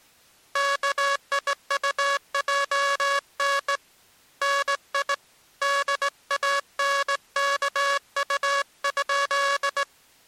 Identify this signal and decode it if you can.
Morse code, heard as a buzzer, hand-sent with a straight key, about 19 wpm. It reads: KIUJN NI DANKU?